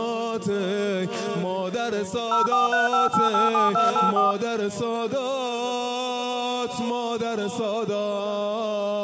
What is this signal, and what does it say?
DTMF, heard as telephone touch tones, dialled by machine, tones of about 150 ms. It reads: 0435887284